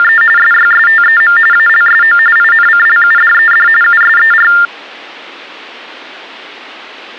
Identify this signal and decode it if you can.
TTY/TDD text telephone tones (45.45 baud Baudot), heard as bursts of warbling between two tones, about 400 Hz shift, 1600 Hz centre. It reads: … SYSTEM ALSO INCLUDED USER